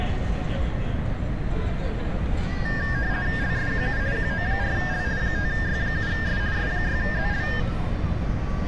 RTTY (50 baud, 170 Hz shift), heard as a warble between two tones, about 1700 Hz centre, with radio static and street noise. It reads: LSQU QO4L 5Y7S S6ZL